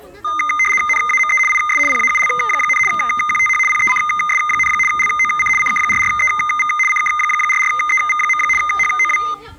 RTTY (75 baud, 850 Hz shift), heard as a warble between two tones, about 1650 Hz centre, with the noise of a park. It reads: NAME IS PAUL, QTH PECS, LOC CK44EV CK44EV. HOW